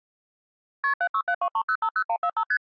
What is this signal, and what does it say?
Multi-frequency trunk signalling (R1, as on North American trunks), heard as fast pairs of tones, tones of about 70 ms. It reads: KP 76723050145 ST